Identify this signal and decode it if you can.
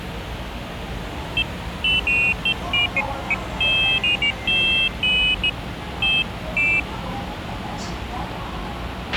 Pairs of high tones at irregular times, with radio hiss, a squelch burst at the end and the noise of a subway station. There is no code.